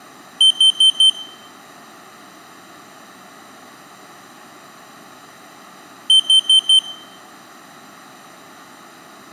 Alarm pattern, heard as an alarm's beeps, played twice, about 3100 Hz, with room echo. Temporal four. Carbon monoxide.